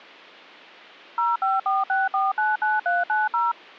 DTMF, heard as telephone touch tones, dialled by machine, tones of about 180 ms. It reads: 0546499390